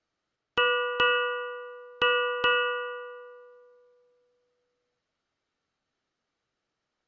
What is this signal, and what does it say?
Ship's bell, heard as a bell, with room echo. 4. Four half-hours of the watch have passed.